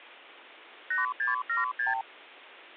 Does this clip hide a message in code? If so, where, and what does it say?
Yes: multi-frequency trunk signalling (R2, with the far end's replies) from 0.9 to 2.0 s, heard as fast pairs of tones, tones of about 150 ms. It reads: 8676